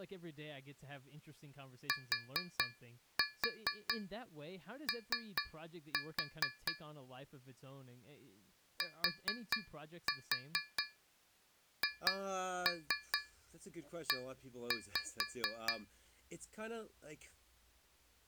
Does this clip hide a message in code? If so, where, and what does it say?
Yes: tap code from 1.9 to 15.9 s, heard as taps on a metal pipe, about 4 knocks a second, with speech in English. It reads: TO THE